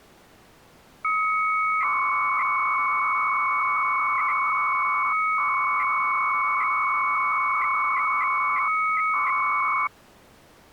300-baud modem data (Bell 103 tones), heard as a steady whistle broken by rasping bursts, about 300 baud, 200 Hz shift.